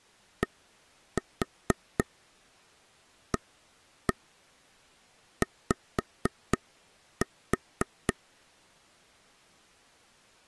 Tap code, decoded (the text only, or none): DAY